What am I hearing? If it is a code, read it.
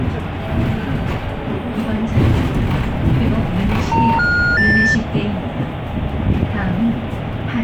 Telephone call progress tone (North American plan), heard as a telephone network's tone, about 910, 1430, 1800 Hz, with the noise inside a bus. Special information tone.